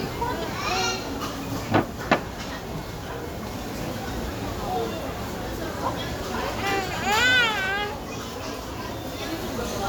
The noise of a restaurant. There is no code.